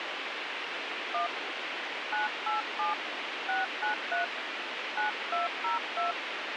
DTMF, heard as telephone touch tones, dialled by hand, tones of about 140 ms, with radio hiss. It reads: 1 987 693 9202